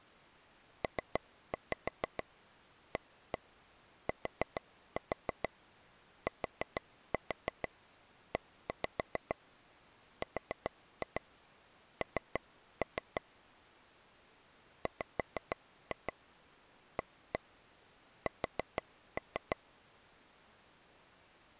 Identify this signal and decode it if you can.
Tap code, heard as taps on a table, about 6 knocks a second. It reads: PATTERN WAS